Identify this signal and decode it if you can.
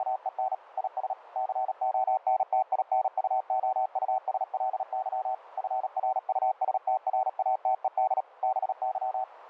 Morse code, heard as a keyed tone, machine-sent, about 37 wpm, 760 Hz, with radio static. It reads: … IS CONTINUOUSLY FRUSTRATED BY